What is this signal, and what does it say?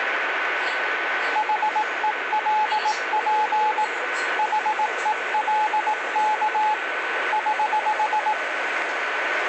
Morse code, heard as a keyed tone, hand-sent with a paddle, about 18 wpm, 860 Hz, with radio static, a steady whistle near 1510 Hz and the noise inside a subway train. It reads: HELP HELK <HH>